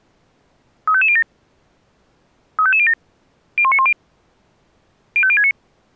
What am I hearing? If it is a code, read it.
Five-tone selective call (ZVEI), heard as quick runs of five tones, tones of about 70 ms. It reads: 35507 35507 01910 05069